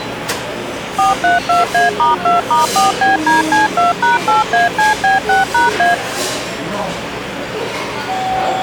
DTMF, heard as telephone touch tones, dialled by machine, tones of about 150 ms, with the noise of a restaurant. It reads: 432A*2*4BDC2#8ACB6#A